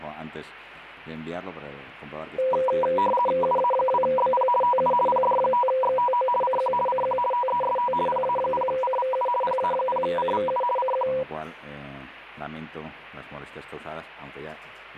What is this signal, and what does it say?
RTTY (50 baud, 450 Hz shift), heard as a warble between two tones, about 740 Hz centre, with radio static. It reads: UA2BP TU PD5XTO CQ CQ TEST PA0CVU PA0CVU CQ